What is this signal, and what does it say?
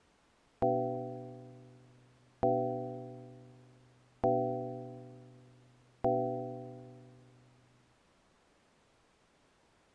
Clock strike, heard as a bell. 4. Four o'clock.